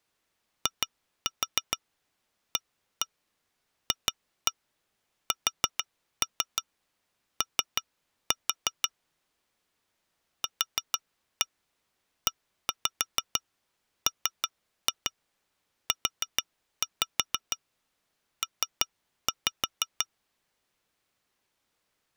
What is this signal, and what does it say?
Tap code, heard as taps on glass, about 6 knocks a second. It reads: IAFSO QEMUP